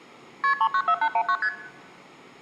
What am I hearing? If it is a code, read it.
Multi-frequency trunk signalling (R1, as on North American trunks), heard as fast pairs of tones, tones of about 70 ms. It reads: KP 394819 ST